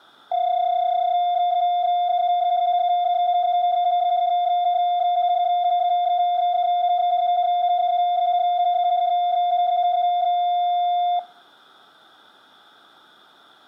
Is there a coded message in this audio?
Yes: PSK31 (31.25 baud) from 0.3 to 11.2 s, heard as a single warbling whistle, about 710 Hz.